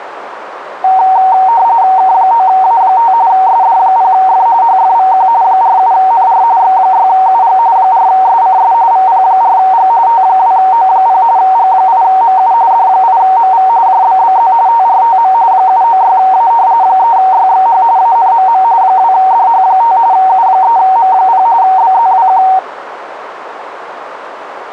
RTTY (45.45 baud, 170 Hz shift), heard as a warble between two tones, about 840 Hz centre, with radio static. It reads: K9A5 SD0F HFVQ 47NR X6UG 4SCS VP4G T2O0 G8MU D8MV JBBZ TRTM 796A 3YXH ANMM 2DH5 U3M0 BZWQ